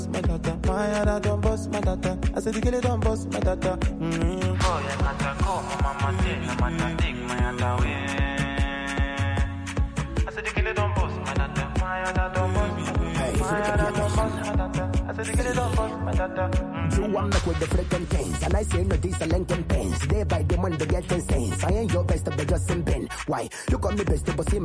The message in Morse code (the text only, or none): none